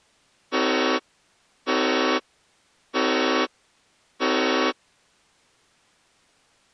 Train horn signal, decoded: 4 short

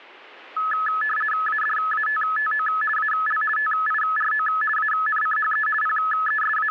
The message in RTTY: ADATTO AL TIRO ANCHE …

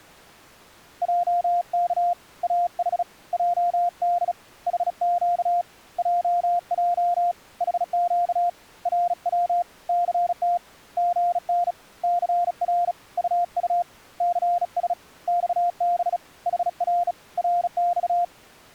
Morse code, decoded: JK AH JD HQ JJ HQ RW CT GN CR UU CS XB HR RX

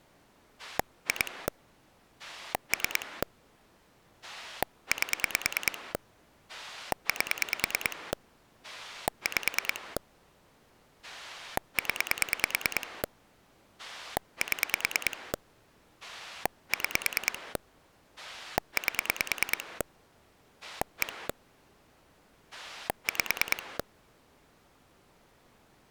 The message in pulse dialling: 2 3 8 8 5 0 7 6 8 1 5

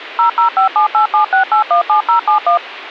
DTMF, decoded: 0057876817071

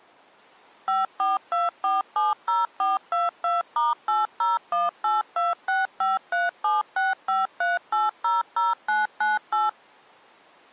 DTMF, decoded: 542470422*801826537653800998

